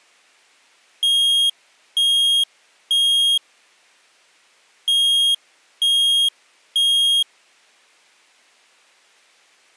Alarm pattern, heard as an alarm's beeps, played twice, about 3250 Hz. Temporal three. Smoke or fire, evacuate.